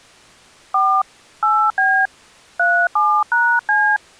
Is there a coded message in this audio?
Yes: DTMF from 0.7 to 4.0 s, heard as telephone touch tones, dialled by hand, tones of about 280 ms. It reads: 4 8B 37#C